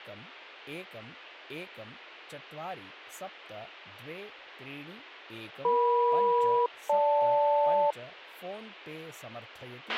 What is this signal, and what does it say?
Aircraft SELCAL, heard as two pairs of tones, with a squelch burst at the end and speech in Sanskrit. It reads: EM-GL